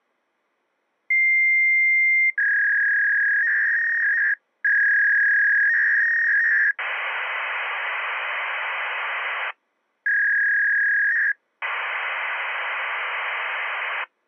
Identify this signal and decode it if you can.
Fax machine handshake, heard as a long tone, a warble and hiss.